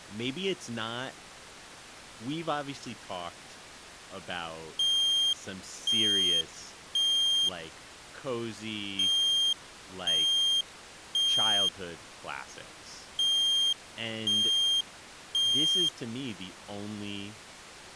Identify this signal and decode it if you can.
Alarm pattern, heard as an alarm's beeps, played three times, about 3200 Hz, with speech in English. Temporal three. Smoke or fire, evacuate.